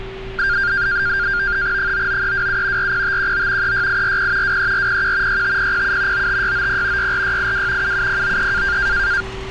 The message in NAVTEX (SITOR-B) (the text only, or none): 99327 40519 36840 23401 65007 95690 64682 77093